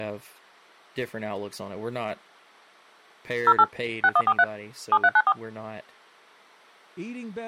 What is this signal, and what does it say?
DTMF, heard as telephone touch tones, dialled by machine, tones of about 50 ms, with speech in English. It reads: 08 6143 7394